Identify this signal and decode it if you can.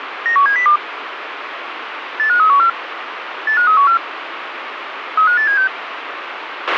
Five-tone selective call (CCIR), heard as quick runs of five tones, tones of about 100 ms, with radio hiss and a squelch burst at the end. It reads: 91702 85314 85314 35876